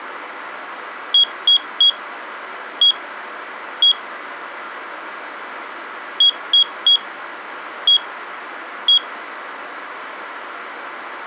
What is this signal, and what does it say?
Beep code, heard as a piezo beeper, played twice, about 3300 Hz. 3-1-1. In Phoenix BIOS tables: DMA register failure.